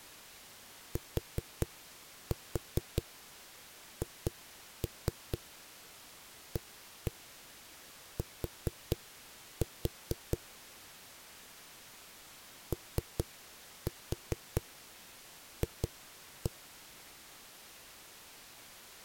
Tap code, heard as knocks on a wall, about 4 knocks a second. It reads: THAT OF